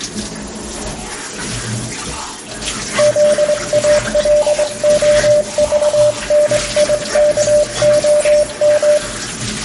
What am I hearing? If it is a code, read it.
Morse code (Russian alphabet), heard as a keyed tone, hand-sent with a straight key, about 23 wpm, 600 Hz, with room echo and kitchen noise. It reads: ЗАЛОЖНИКОМ